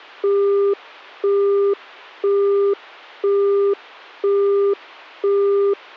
Telephone call progress tone (single-tone plan, as in Europe, Japan and elsewhere), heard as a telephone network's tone, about 400 Hz, 0.5 s on and 0.5 s off. Busy tone.